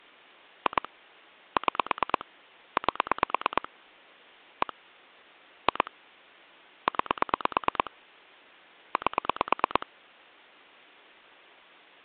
Pulse dialling, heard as clicks on a phone line, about 9 pulses a second. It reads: 2 6 8 1 2 9 8